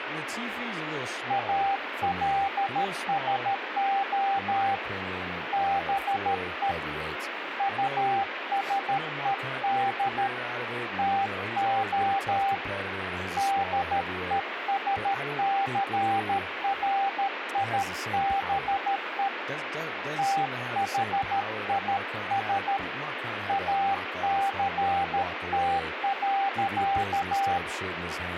Morse code, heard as a keyed tone, hand-sent with a paddle, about 13 wpm, 790 Hz, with radio static and speech in English. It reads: ALSO BE USED TO DESCRIBE THIS ACT.